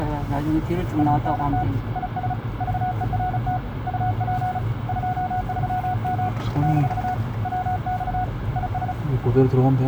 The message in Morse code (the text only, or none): ANT IS VERT UP 23M - WX IS